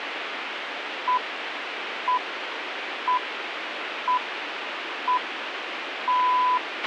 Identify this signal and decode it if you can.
Radio time signal (six pips, as the Greenwich Time Signal), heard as pips, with radio hiss and a squelch burst at the end.